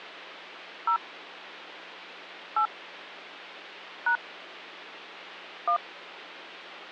DTMF, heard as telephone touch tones, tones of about 90 ms, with hum. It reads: 0 8 # 1